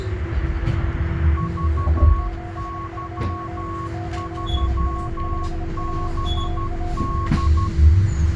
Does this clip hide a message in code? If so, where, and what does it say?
Yes: Morse code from 1.3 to 7.7 s, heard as two keyed tones, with radio static and the noise inside a bus. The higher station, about 12 wpm, 1100 Hz: VY3BD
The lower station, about 26 wpm, 710 Hz: 72 9A5UMA